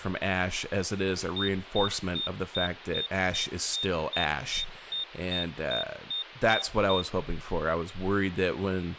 Evenly repeated beeps, with speech in English. There is no code.